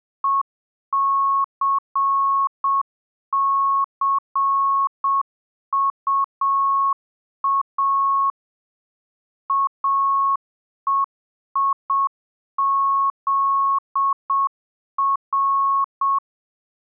Morse code, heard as a keyed tone, machine-sent, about 7 wpm, 1100 Hz. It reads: ECCUA AEIZR